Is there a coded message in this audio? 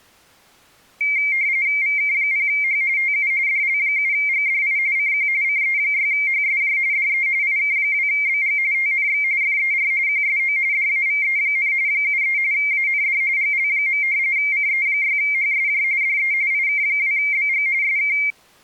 Yes: RTTY (45.45 baud, 170 Hz shift) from 1.0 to 18.3 s, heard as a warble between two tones, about 2200 Hz centre. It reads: VK0H TU DL7GDI CQ CE6HSJ DE IK2BG TNX FER QSO DAVE, 73 AND GL. CE6HSJ DE IK2BG SK